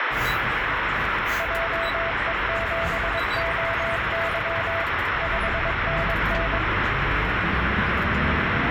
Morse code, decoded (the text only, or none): JE7OY 5NN